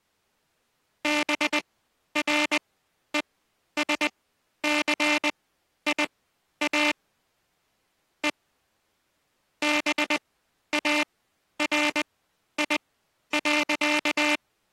Morse code, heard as a buzzer, machine-sent, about 20 wpm, spaced as for 11 wpm. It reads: BRESCIA E BARI.